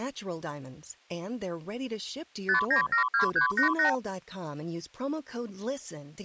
Multi-frequency trunk signalling (R2, with the far end's replies), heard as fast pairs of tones, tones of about 110 ms, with speech in English. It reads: 5972388